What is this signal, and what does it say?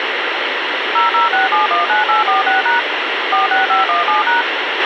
DTMF, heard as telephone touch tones, dialled by machine, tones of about 140 ms, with radio hiss and a squelch burst at the end. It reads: 006719846# 46517#